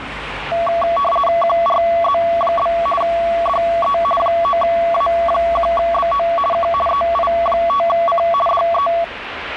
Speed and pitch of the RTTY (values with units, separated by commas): 50 baud, 450 Hz shift, 900 Hz centre